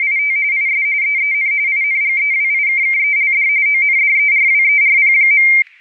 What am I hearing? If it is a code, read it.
RTTY (45.45 baud, 170 Hz shift), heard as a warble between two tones, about 2200 Hz centre, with static crashes. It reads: … IS EEN INGEWIKKELD ONDERWERP.